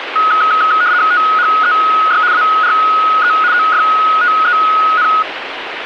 RTTY (75 baud, 170 Hz shift), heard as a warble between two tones, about 1360 Hz centre, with radio static. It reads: THEY ARE OFTEN